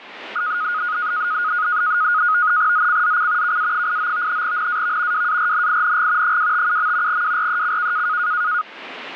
NAVTEX (SITOR-B), 100 baud, 170 Hz shift, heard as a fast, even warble, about 1350 Hz centre, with radio static. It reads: ZCZC KA89 NAV WARNING 257. WRECK